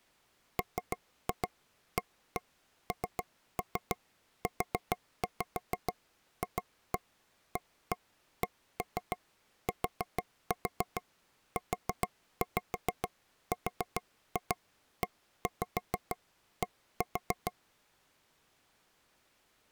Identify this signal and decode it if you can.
Tap code, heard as taps on a table, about 6 knocks a second. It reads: MANUFACTURED